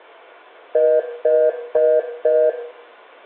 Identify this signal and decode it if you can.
Telephone call progress tone (North American plan), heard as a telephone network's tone, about 480, 620 Hz, 0.25 s on and 0.25 s off, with room echo. Congestion tone.